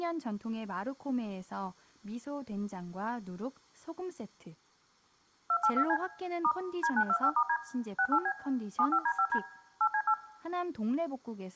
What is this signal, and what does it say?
DTMF, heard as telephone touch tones, dialled by machine, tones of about 70 ms, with speech in Korean. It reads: 282C * D925*D 68B 75D5D 8C8